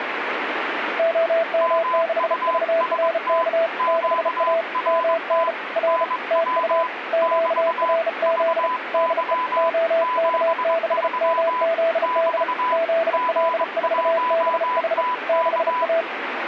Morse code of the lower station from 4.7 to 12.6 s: MN R TU QRZ DE OK6MZD

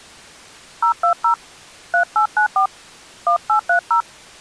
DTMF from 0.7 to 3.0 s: 020 3894

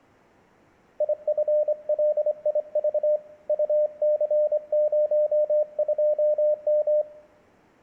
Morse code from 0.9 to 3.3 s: IFLIV

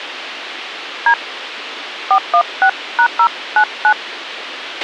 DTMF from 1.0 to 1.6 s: D

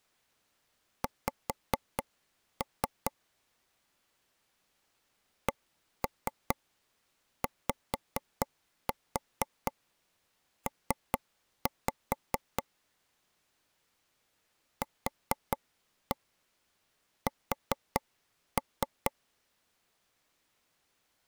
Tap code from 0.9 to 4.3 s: X

